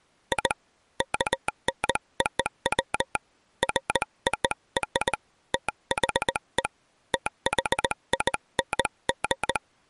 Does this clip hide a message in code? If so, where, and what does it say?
Yes: Morse code (American railroad code) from 0.3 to 9.6 s, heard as a telegraph sounder, hand-sent with a straight key. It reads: I KNOW FOR THE THING